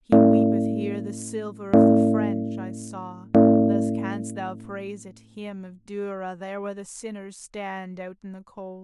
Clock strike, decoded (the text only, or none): 3